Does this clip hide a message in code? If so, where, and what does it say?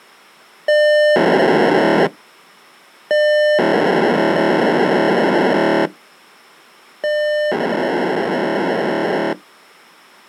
Yes: POCSAG pager data (1200 baud) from 0.7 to 9.3 s, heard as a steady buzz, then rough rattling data.